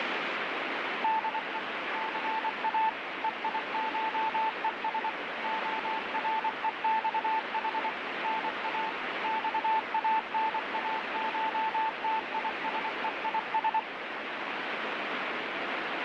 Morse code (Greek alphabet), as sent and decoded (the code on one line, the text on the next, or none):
-.. . / -.-. .- / . .. ---- . ... / --- .-. . -..- .... / -. .- / -..- .- -. .- ---- - .. ... . .. ...
ΔΕ ΘΑ ΕΙΧΕΣ ΟΡΕΞΗ ΝΑ ΞΑΝΑΧΤΙΣΕΙΣ